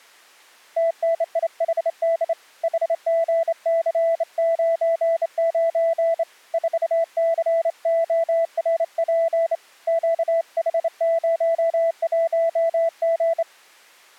Morse code, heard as a keyed tone, hand-sent with a straight key, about 27 wpm, 660 Hz. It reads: TNIHD HGC99 4CORP QH01G